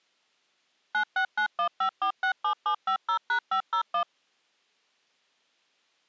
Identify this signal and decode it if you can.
DTMF, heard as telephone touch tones, dialled by machine, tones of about 90 ms. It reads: 96915467750#501